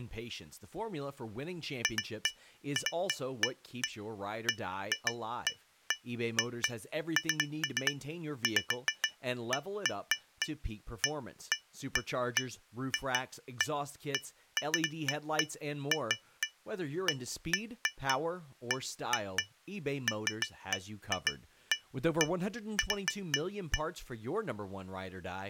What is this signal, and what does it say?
Irregular taps on glass, with speech in English. There is no code.